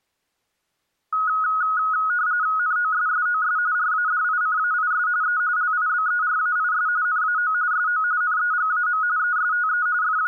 RTTY (45.45 baud, 170 Hz shift), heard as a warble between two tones, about 1360 Hz centre. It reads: NOSSOS RADICAIS E LIBERAIS NAO SO NEGAM ESTE …